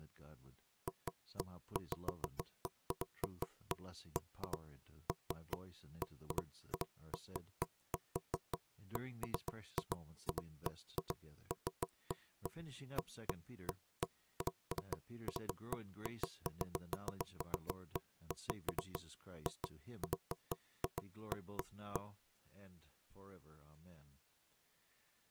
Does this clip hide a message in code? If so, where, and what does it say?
No, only irregular knocks on wood.